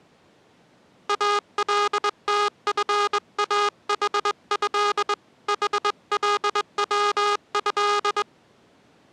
Morse code (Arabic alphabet), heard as a buzzer, hand-sent with a straight key, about 21 wpm. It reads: التفاحه حلوه